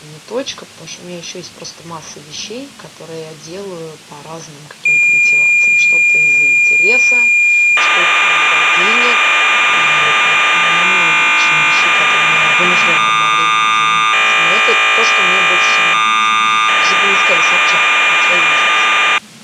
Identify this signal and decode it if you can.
Cassette data (Kansas City type), 1200 baud, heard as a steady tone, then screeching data.